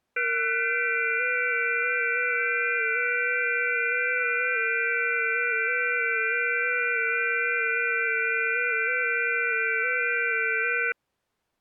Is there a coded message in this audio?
Yes: FT8 (several signals at once) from 0.2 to 10.9 s, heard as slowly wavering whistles, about 6.25 baud.